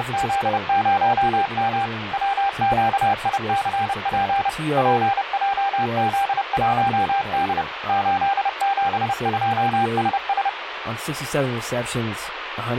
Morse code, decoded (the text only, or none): … WQICP PJZ1D 872SS